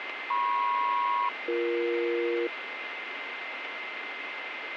Aircraft SELCAL, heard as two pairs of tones, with radio static and a steady whistle near 2080 Hz. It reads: MP-BE